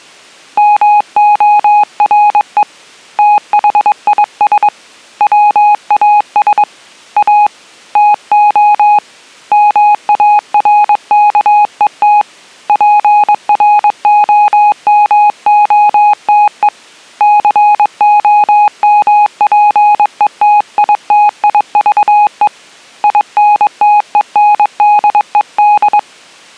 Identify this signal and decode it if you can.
Morse code, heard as a keyed tone, hand-sent with a paddle, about 22 wpm, 830 Hz. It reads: MORE THIS WAS A TO MARKET PROMOTE COMPETITIVE INTENDED